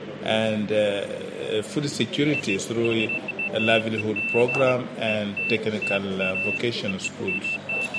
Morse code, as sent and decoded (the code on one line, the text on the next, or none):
none